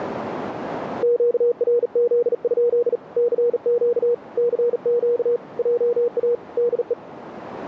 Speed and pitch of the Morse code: 39 wpm, 480 Hz

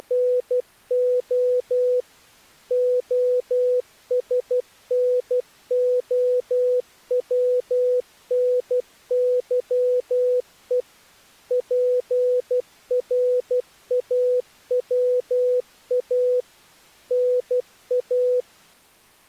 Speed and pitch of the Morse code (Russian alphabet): 12 wpm, 500 Hz

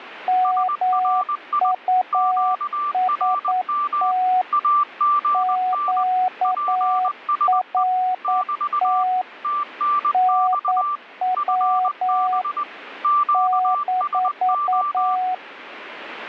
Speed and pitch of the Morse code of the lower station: 9 wpm, 740 Hz

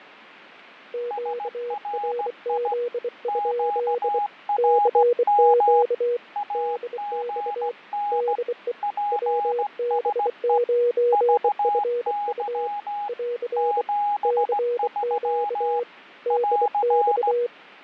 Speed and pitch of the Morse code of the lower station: 24 wpm, 480 Hz

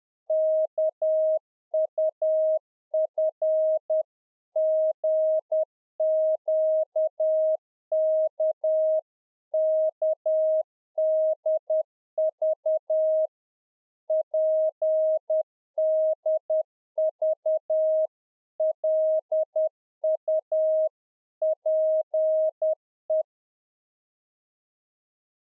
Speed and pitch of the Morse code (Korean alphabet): 10 wpm, 630 Hz

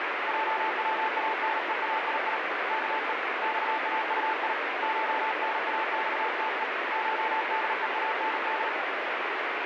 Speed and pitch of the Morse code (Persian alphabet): 38 wpm, 880 Hz

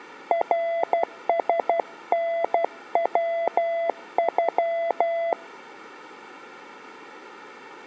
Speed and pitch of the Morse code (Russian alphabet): 12 wpm, 670 Hz

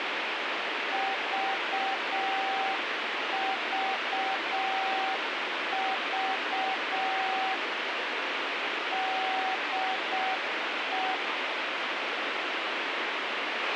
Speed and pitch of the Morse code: 6 wpm, 770 Hz

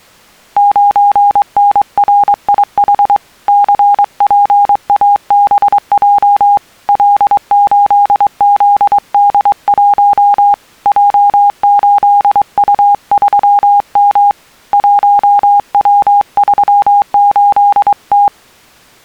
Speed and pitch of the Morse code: 23 wpm, 810 Hz

